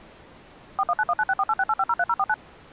DTMF, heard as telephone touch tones, dialled by machine, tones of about 50 ms. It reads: 4191964868503049